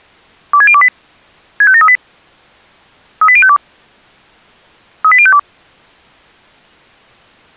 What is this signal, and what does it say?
Five-tone selective call (ZVEI), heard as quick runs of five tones, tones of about 70 ms. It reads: 26028 65738 38052 38052